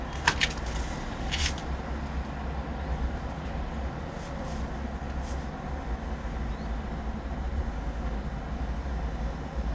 The noise of a residential street. There is no code.